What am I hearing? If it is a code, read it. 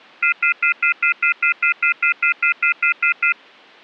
Telephone call progress tone (North American plan), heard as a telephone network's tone, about 1400, 2050, 2450, 2600 Hz, 0.1 s on and 0.1 s off. Off-hook warning tone.